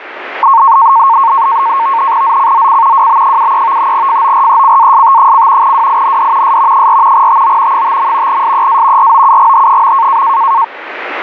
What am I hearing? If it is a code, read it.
NAVTEX (SITOR-B), 100 baud, 170 Hz shift, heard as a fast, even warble, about 1000 Hz centre, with radio static. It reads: ZCZC WB73 FORECAST: WIND S 4 TO 5. SEA ROUGH.